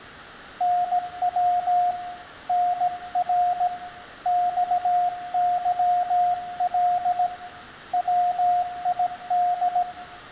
Morse code, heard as a keyed tone, hand-sent with a paddle, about 17 wpm, 710 Hz, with room echo. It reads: NW NR XYL WID